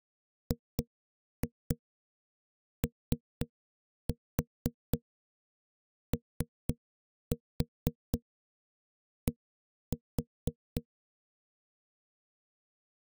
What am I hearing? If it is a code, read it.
Tap code, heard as knocks on a wall, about 4 knocks a second. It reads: GOOD